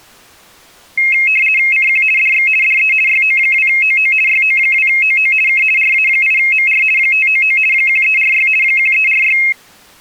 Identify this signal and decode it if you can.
RTTY (50 baud, 450 Hz shift), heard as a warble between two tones, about 2350 Hz centre. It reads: CQ DX DE YO2OO YO2OO K RA8MR 599 1346 1346